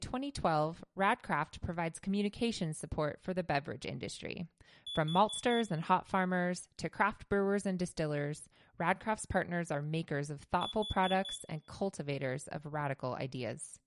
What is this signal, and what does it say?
Alarm pattern, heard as an alarm's beeps, played twice, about 3450 Hz, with room echo and speech in English. Temporal four. Carbon monoxide.